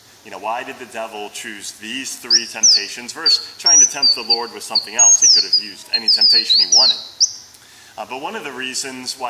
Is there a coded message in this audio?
No, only bird-like chirps, with room echo.